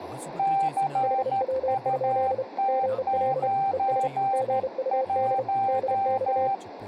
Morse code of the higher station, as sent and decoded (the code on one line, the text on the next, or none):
-.-. ..- - ----. .----
CUT91